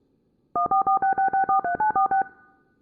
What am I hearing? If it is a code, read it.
DTMF, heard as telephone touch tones, dialled by machine, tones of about 110 ms. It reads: 14466643946